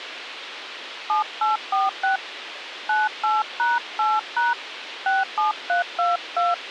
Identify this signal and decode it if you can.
DTMF, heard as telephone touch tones, dialled by hand, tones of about 170 ms, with radio hiss. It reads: 7846 98#8# 67322